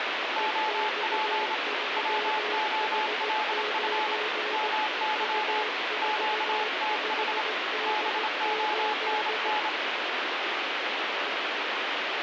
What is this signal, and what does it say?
Morse code, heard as two keyed tones, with heavy radio static. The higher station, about 27 wpm, 860 Hz: OP WOLF MY QTH BONN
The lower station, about 17 wpm, 430 Hz: EX3H9 U45D8